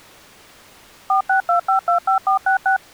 DTMF, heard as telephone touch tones, dialled by machine, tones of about 110 ms. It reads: 462525466